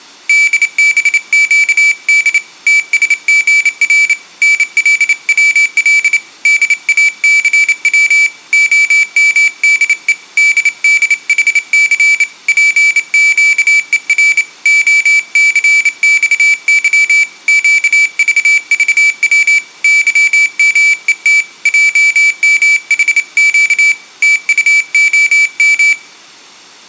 Morse code, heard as a high beeper, hand-sent with a bug key, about 28 wpm, 2300 Hz, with room echo. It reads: DBQD TSGR NLWL DACW OMDE DDHC PQER OCXY QVVW YMET JMHQ TUOM